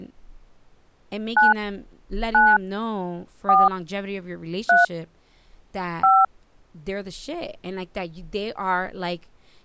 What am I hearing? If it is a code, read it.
DTMF, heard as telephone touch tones, dialled by hand, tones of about 190 ms, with speech in English. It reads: 9 9 4 3 5